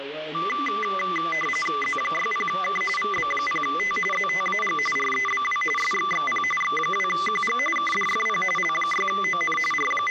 RTTY (45.45 baud, 850 Hz shift), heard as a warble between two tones, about 1600 Hz centre, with radio static. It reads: Z60K VB0T ZTAG REBW SXXP X2QG KDFP L6ON …